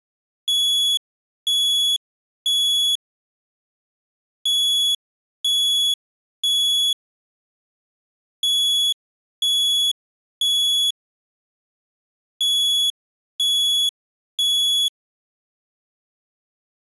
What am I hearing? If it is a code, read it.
Alarm pattern, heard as an alarm's beeps, played four times, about 3400 Hz. Temporal three. Smoke or fire, evacuate.